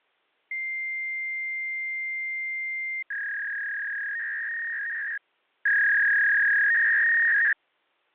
Fax machine handshake, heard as a long tone and a warble.